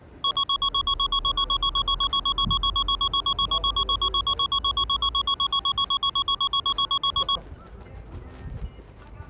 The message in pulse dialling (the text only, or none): none